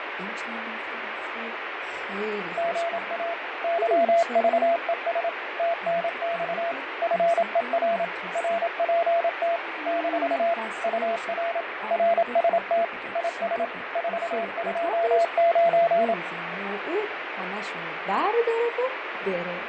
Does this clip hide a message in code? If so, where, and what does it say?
Yes: Morse code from 2.5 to 16.2 s, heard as a keyed tone, machine-sent, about 27 wpm, 680 Hz, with radio static and fading. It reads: GA YVES TNX FER RPT - UR RST IS 429